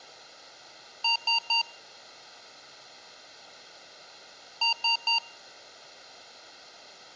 Beep code, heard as beeps from a small speaker, played twice, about 930 Hz, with room echo. 3 short. In AMI BIOS tables: failure in the first 64 KB of memory; in Dell tables: chipset error.